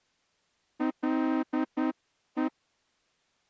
Morse code, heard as a horn, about 10 wpm. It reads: LE